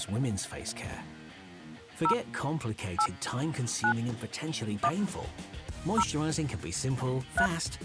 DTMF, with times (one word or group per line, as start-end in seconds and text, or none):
2.0-2.1 0
3.0-3.1 8
3.8-3.9 9
4.8-4.9 1
6.0-6.0 0
7.4-7.5 3